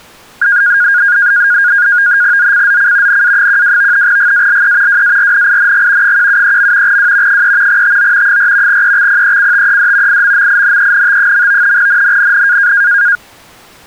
NAVTEX (SITOR-B), 100 baud, 170 Hz shift, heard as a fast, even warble, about 1550 Hz centre. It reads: ZCZC NA12 GALE WARNING 173. W 3 TO 4 EXPECTED IMMINENT. NNNN